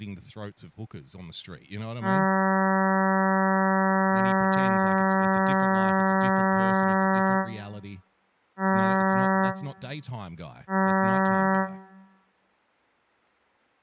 Ship horn signal, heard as a ship's horn, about 190 Hz, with room echo and speech in English. 1 long, 2 short. At sea: a vessel in fog that is sailing, fishing, towing or hampered.